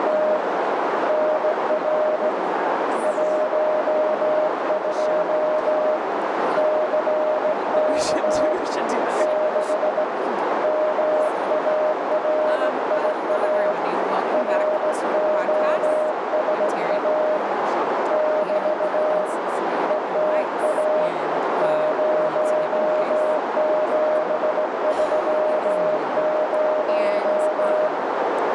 Morse code, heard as a keyed tone, hand-sent with a straight key, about 17 wpm, 620 Hz, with heavy radio static, a narrow filter and speech in English. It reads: … NR 12 CK 6 MARIA ROSA <BT> ETA 0730